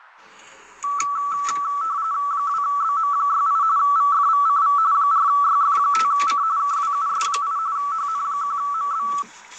RTTY (45.45 baud, 170 Hz shift), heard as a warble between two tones, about 1230 Hz centre, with the noise inside a car. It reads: 2BM68 VFVCV 4YF5C KWUS8 HN1MB